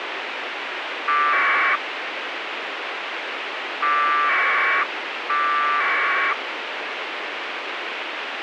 Packet radio (AX.25, as in APRS), 1200 baud, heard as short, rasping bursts, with radio hiss.